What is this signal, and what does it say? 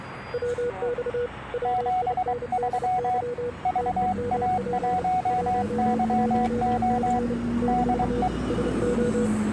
Morse code, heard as two keyed tones, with street noise. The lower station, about 30 wpm, 480 Hz: WX WINDY TEMP 11C - SO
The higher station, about 23 wpm, 740 Hz: 73 VA1YO DE